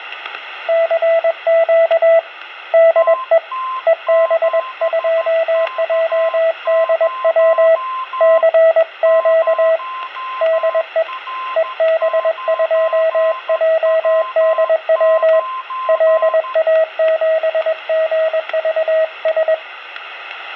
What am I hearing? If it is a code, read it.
Morse code, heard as two keyed tones, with static crashes. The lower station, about 21 wpm, 650 Hz: CQ DE EB2JDW CQ DE EB2JDW LA7GVS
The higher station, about 13 wpm, 1040 Hz: TT7K0 0R9W9